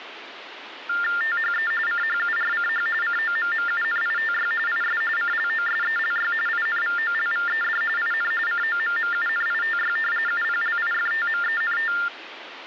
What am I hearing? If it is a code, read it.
TTY/TDD text telephone tones (45.45 baud Baudot), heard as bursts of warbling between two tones, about 400 Hz shift, 1600 Hz centre, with phone line noise. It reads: THE CHURCH COMMUNITY IS CLOSELY INVOLVED IN COMMUNITY UPLIFTMENT